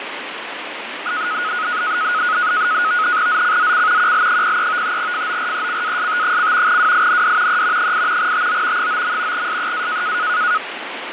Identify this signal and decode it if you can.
NAVTEX (SITOR-B), 100 baud, 170 Hz shift, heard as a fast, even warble, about 1360 Hz centre, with radio static. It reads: ZCZC QL03 FORECAST: WIND E 8 TO 9. SEA